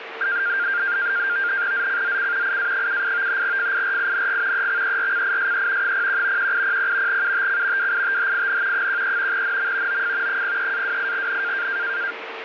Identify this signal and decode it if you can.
NAVTEX (SITOR-B), 100 baud, 170 Hz shift, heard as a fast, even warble, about 1500 Hz centre, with radio static and a steady whistle near 450 Hz. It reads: ZCZC IA78 FIRING EXERCISE 01 1800 UTC WITHIN 13 NM OF 03-28N